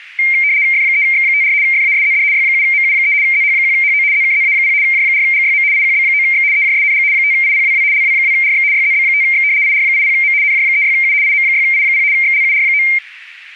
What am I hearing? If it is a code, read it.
RTTY (75 baud, 170 Hz shift), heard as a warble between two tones, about 2200 Hz centre. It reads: F3X54 FASZD Y7MU3 ZH1HO ZKZA0 J4GYM IQB9X EJSNG 5IPWW LW2RX YZB5X IR80M NJ36U IM6I0 XLUR9